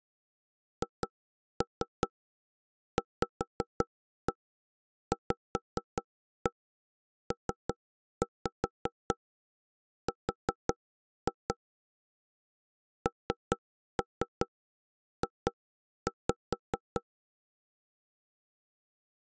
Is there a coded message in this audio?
Yes: tap code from 0.8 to 17.0 s, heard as knocks on wood, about 5 knocks a second. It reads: HVVPR NJ